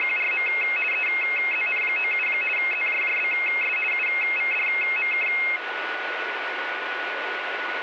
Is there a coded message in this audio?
Yes: RTTY (50 baud, 450 Hz shift) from 0.0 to 5.6 s, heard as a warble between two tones, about 2350 Hz centre, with radio static and a steady whistle near 1470 Hz. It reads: … EZN97 ZJJBS UVDMK